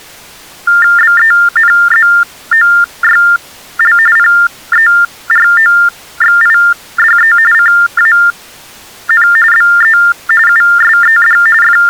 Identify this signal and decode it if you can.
TTY/TDD text telephone tones (45.45 baud Baudot), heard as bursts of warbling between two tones, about 400 Hz shift, 1600 Hz centre. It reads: BENZOYL PEROXIDE CAN BE USED …